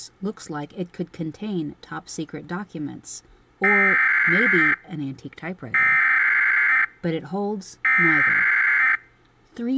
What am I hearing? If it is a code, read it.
Emergency Alert System (SAME) tones (header bursts), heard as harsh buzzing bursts, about 520.83 baud, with speech in English.